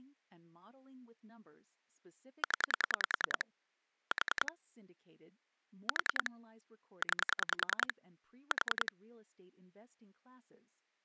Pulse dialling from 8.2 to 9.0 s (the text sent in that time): 4